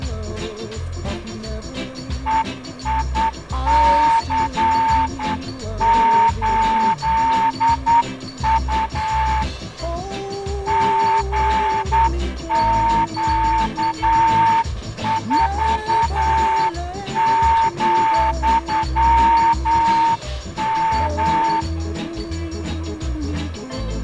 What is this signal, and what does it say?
Morse code, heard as a whistle, hand-sent with a straight key, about 9 wpm, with room echo. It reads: EIC8U GQ4,M